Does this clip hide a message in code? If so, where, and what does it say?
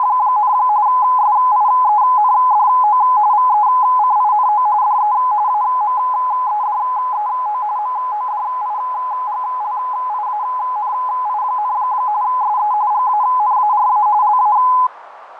Yes: RTTY (45.45 baud, 170 Hz shift) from 0.0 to 14.9 s, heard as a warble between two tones, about 920 Hz centre, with radio static, fading and a narrow filter. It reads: … SIENDO VECINO DE AMEDEO MODIGLIANI, SE GANARA LA